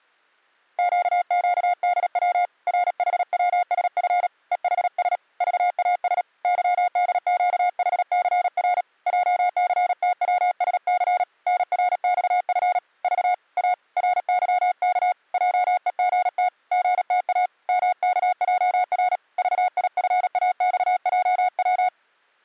Morse code, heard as a keyed tone, hand-sent with a paddle, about 37 wpm, 720 Hz. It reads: QQDW RHWSF EHS VAS YDQHCR JCTWSC NRXF V A RYK JEGT GTA MKJR VIFAXJW